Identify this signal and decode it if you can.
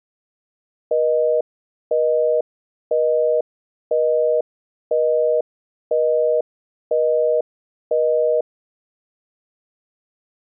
Telephone call progress tone (North American plan), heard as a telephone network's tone, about 480, 620 Hz, 0.5 s on and 0.5 s off. Busy tone.